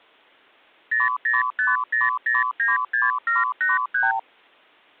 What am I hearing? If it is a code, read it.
Multi-frequency trunk signalling (R2, with the far end's replies), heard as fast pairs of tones, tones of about 170 ms. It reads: 0050096783